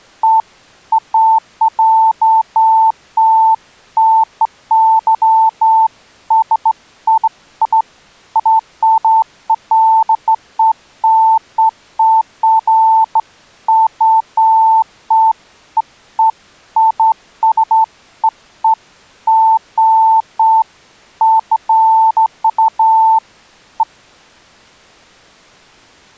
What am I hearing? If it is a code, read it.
Beeps of irregular length. There is no code.